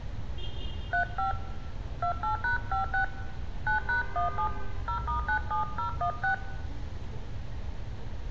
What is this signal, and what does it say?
DTMF, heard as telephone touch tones, dialled by hand, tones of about 100 ms, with a squelch burst at the end, room echo and street noise. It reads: 35 28#56 9#17 0*97016